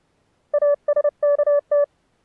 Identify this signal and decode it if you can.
Morse code (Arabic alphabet), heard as a keyed tone, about 30 wpm, 580 Hz. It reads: اسكت